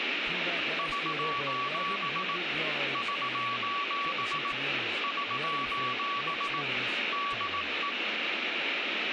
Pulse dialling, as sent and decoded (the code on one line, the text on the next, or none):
none